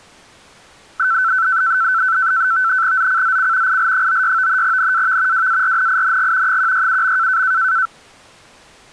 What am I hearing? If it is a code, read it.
NAVTEX (SITOR-B), 100 baud, 170 Hz shift, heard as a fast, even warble, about 1430 Hz centre. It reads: ZCZC IL96 NAV WARNING 167.